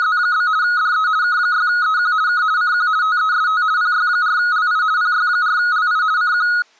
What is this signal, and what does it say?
RTTY (50 baud, 170 Hz shift), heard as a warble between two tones, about 1360 Hz centre. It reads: … DE K6EQ K CQ TEST PY4LI PY4LI CQ